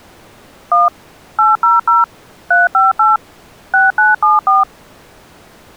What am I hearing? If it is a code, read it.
DTMF, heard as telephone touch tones, dialled by machine, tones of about 170 ms. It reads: 1 800 358 6974